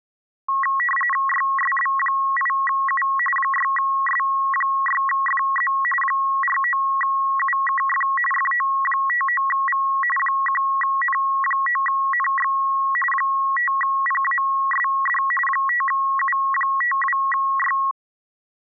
RTTY (45.45 baud, 850 Hz shift), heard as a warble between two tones, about 1500 Hz centre. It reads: YSB8U 6S6FZ 49UKF FO59V 1N9NX 5PASD 5U52Y